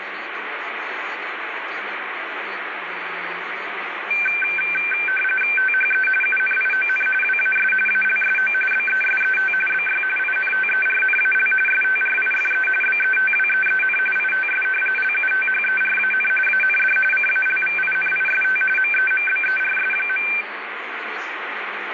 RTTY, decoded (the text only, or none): THE UNION WAS ALSO BESET BY INTERNAL STRIFE BETWEEN ITS LUTHERAN AND CALVINIST MEMBERS.